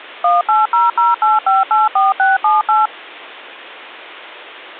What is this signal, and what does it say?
DTMF, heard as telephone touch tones, dialled by machine, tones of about 170 ms. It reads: 18008584678